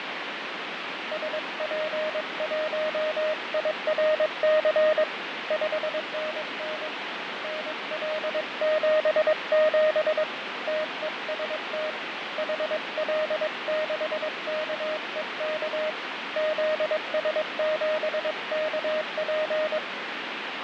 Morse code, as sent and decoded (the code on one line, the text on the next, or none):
... .--. .---- .. .-. -.-. / ..... -. -. / -. .-.. --... --... / - . ... - / .... .-.. -.... -.- . -.- / --.. ... --... -.- .--.
SP1IRC 5NN NL77 TEST HL6KEK ZS7KP